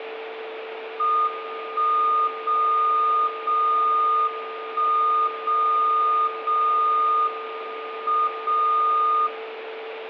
Radio time signal (WWVB), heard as a tone whose level steps once a second, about 1220 Hz, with radio static, a steady whistle near 450 Hz and room echo. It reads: 1 0 0 1 0 0 M 0